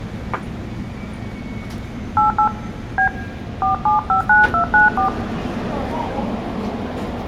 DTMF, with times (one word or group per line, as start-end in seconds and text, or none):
2.2-2.5 88
3.0-3.1 B
3.6-5.1 4759294